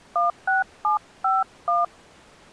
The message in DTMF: 16751

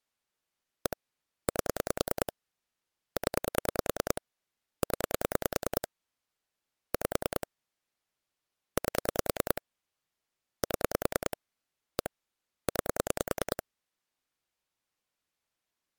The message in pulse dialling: 1 8 0 0 5 8 7 1 9

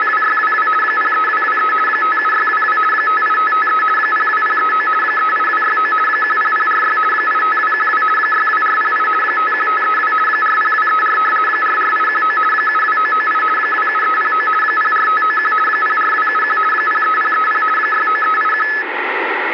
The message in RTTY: … 03223 57622 58553 02039 38269 10046 85212 62408 51532 40234 44819 72998 27309 04591 04271 03030 69381

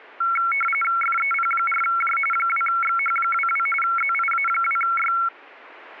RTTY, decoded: FEP4J 2XH22 ZIA2Y

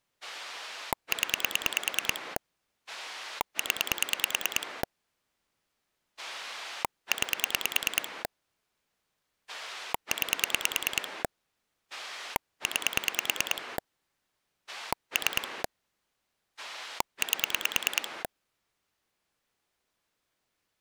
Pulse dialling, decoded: 0 0 9 9 9 3 8

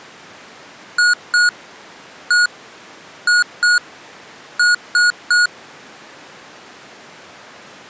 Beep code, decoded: 2-1-2-3

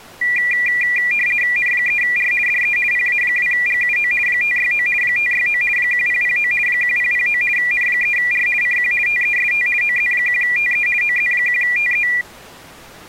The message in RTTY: N3R DE PA2GUO 569 569 1009 1009 N3R CQ TEST OZ1TE OZ1TE

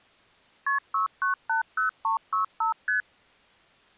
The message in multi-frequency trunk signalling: KP 6980365 ST

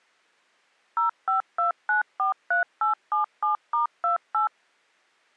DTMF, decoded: 052943877*28

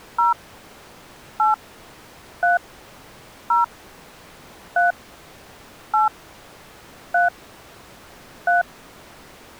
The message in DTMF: 0 8 3 0 3 8 3 3

